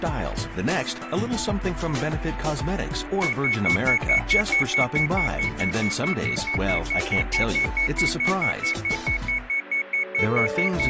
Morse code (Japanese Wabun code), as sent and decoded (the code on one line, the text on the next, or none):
none